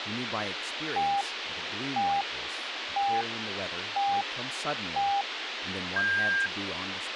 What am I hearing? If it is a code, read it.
Radio time signal (five pips and a higher one, as on Chinese radio), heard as pips, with radio hiss and speech in English.